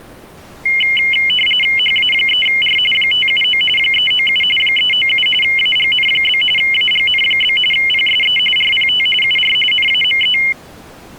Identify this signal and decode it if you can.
RTTY (45.45 baud, 850 Hz shift), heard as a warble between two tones, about 2550 Hz centre. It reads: HA3R 579 397 397 AGN? AGN? PSE RPT UR NAME